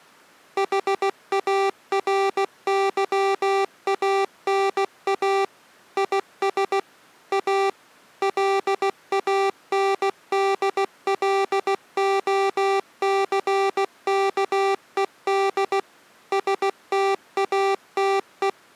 Morse code, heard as electronic beeps, machine-sent, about 16 wpm, 390 Hz. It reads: HARYANA IS A LANDLOCKED STATE